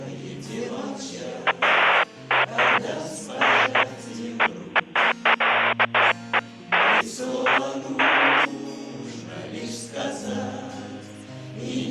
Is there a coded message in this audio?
No, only bursts of noise.